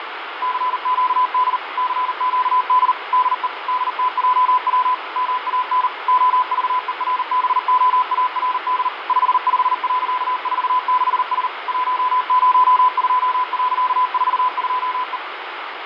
Morse code, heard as a keyed tone, machine-sent, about 39 wpm, 1010 Hz, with radio static and fading. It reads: CQD CQD DE DTJW MAN OVERBOARD 55.46S 102.42E